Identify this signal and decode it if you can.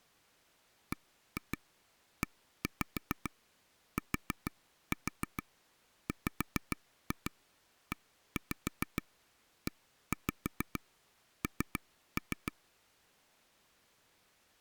Tap code, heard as taps on a table, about 6 knocks a second. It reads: BETWEEN